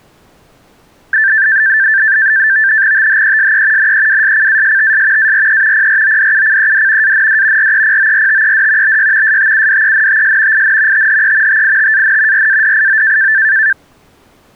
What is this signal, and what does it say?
NAVTEX (SITOR-B), 100 baud, 170 Hz shift, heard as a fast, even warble, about 1650 Hz centre. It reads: THESE NEWSCASTS ARE PRODUCED AND REPORTED BY STUDENTS IN THE TITAN RADIO